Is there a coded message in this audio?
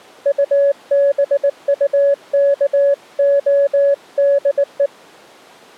Yes: Morse code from 0.2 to 4.9 s, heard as a keyed tone, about 19 wpm, 560 Hz. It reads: UBUKODE